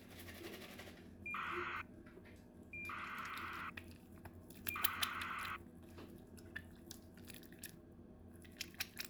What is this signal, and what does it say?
ACARS aircraft data, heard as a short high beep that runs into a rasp, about 2400 baud, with the noise of a restroom.